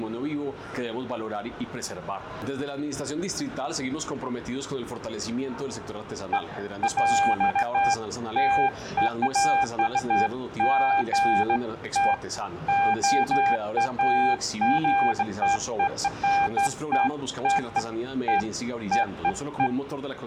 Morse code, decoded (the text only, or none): none